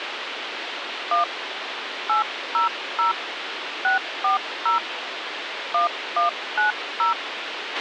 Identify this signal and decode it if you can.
DTMF, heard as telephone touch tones, dialled by hand, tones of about 130 ms, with radio hiss and a squelch burst at the end. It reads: 1 800 640 1190